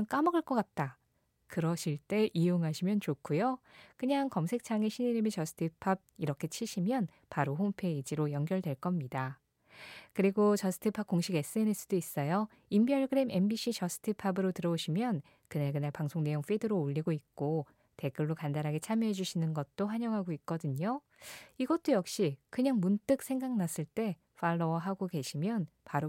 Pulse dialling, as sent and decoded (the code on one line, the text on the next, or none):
none